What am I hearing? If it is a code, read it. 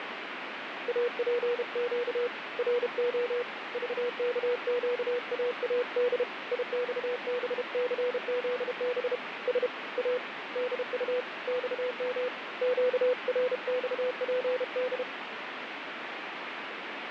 Morse code, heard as a keyed tone, hand-sent with a paddle, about 32 wpm, 490 Hz, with radio static. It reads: APQ RO VKQAAD IXBCZB S A DU XM QRXPD